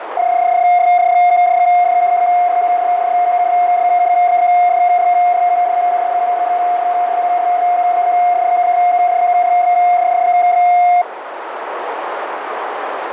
PSK31 (31.25 baud), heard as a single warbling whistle, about 710 Hz, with radio static and a narrow filter.